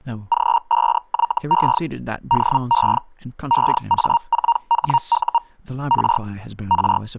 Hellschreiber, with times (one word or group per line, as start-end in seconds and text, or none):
0.3-1.8 G5YE
2.3-3.0 DE
3.5-5.4 EA4HU
5.9-6.2 R
6.7-7.0 R